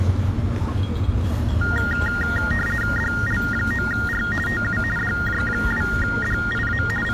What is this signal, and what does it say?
RTTY (50 baud, 450 Hz shift), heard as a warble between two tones, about 1650 Hz centre, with the noise of a park. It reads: DL9R TU DJ2DIA …